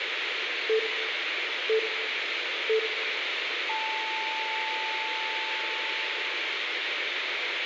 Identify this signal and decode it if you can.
Radio time signal (three low pips and a long one an octave up, as on NHK), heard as pips, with radio hiss and room echo.